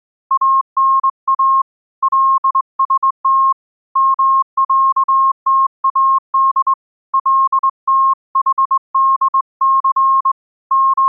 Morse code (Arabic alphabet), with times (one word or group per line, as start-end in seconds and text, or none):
0.3-1.6 انا
2.0-3.5 لست
4.0-6.7 معتاد
7.1-10.3 لتحدث
10.7-11.1 …